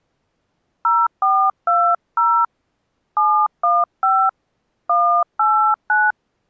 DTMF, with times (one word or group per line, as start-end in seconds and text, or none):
0.8-2.4 0420
3.2-4.3 715
4.9-6.1 189